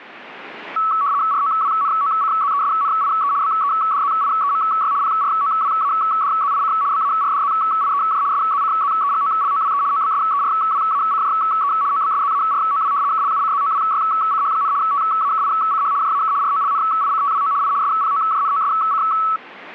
RTTY (75 baud, 170 Hz shift), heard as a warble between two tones, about 1220 Hz centre. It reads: ROWNOCZESNIE BEDZIEMY PROWADZIC BARDZIEJ SZCZEGOLOWE OBSERWACJE OBSZAROW KLUCZOWYCH, TAKICH JAK ROLNICTWO I SPOJNOSC